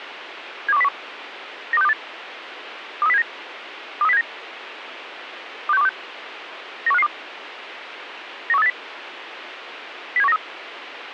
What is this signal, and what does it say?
Five-tone selective call (EEA), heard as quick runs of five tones, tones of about 40 ms, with radio hiss. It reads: 72101 92628 23079 23079 26126 91552 91380 07193